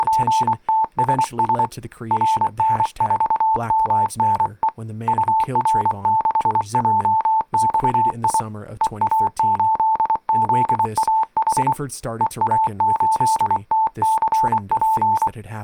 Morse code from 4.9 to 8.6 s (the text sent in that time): UR6JXI